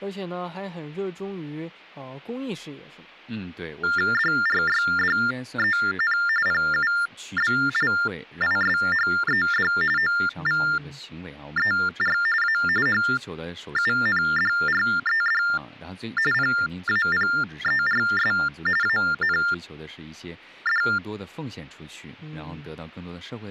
TTY/TDD text telephone tones (45.45 baud Baudot), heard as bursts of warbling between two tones, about 400 Hz shift, 1600 Hz centre, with speech in Chinese. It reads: DRYDEN PUBLISHED OVER A HUNDRED PAPERS AND